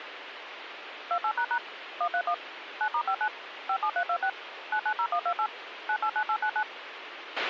DTMF, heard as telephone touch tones, dialled by machine, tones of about 70 ms, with radio hiss and a squelch burst at the end. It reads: 28## 131 9*59 57326 990128 989899